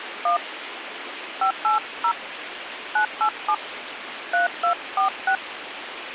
DTMF, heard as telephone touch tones, dialled by hand, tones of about 100 ms, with radio hiss. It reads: 1 580 987 3246